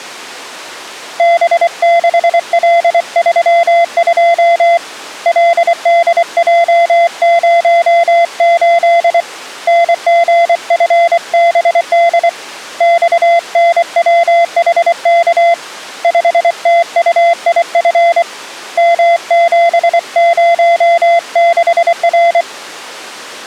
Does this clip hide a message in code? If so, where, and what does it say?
Yes: Morse code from 1.1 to 22.5 s, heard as a keyed tone, hand-sent with a paddle, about 24 wpm, 680 Hz. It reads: B6L32 LDJ08 NGFBD XNWHK 5TUIF M706R